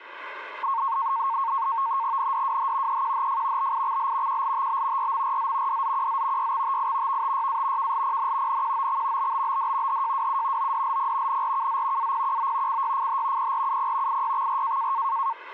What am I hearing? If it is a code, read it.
NAVTEX (SITOR-B), 100 baud, 170 Hz shift, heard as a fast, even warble, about 1000 Hz centre, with radio static. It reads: NDWH EQHF BIXL QLTB RMRZ DZQZ YXTI VTYA KLPN NQOX BBBD HJWU ODLP NRKZ APQO CYFH PRUP IYXR